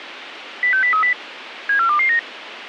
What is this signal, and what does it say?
Five-tone selective call (CCIR), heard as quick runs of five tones, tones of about 100 ms, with radio hiss. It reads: 06030 74229